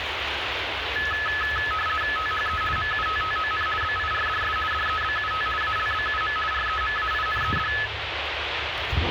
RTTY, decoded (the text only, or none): THE MUTTON BIRDS DEBUT ALBUM REMAINED